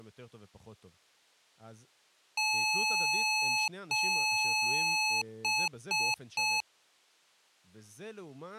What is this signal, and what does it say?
Beep code, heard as beeps from a small speaker, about 860 Hz, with speech in Hebrew. 2 long, 3 short.